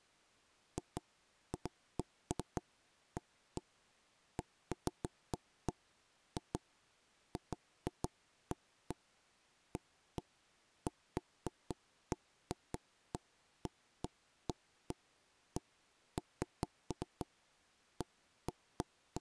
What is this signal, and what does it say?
Irregular knocks on wood. There is no code.